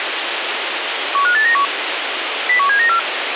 Five-tone selective call (CCIR), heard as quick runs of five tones, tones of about 100 ms, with radio hiss. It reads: 15891 01794